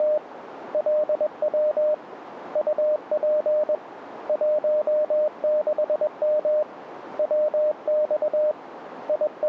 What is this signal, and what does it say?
Morse code, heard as a keyed tone, hand-sent with a paddle, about 21 wpm, 610 Hz, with radio static. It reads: … LW UP 16M WX …